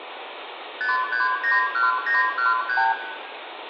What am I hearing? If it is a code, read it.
Multi-frequency trunk signalling (R2, with the far end's replies), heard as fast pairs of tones, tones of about 160 ms, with phone line noise and room echo. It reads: 5391913